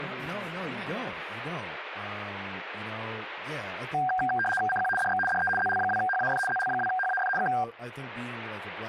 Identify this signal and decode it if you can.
RTTY (75 baud, 850 Hz shift), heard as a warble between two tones, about 1170 Hz centre, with speech in English. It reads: CQ DX DE ZL2HAF ZL2HAF K